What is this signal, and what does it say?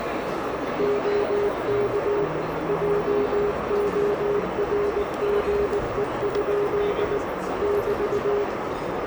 Morse code, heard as a keyed tone, machine-sent, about 19 wpm, 410 Hz, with heavy radio static, a narrow filter and the noise of a crowd indoors. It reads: OK JORGE? <BT>